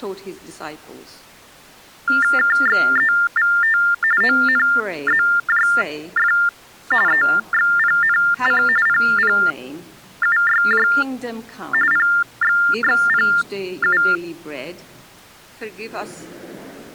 TTY/TDD text telephone tones (45.45 baud Baudot), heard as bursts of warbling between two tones, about 400 Hz shift, 1600 Hz centre. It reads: KXEVT ONZJF EXPNC PPUYJ PXXPU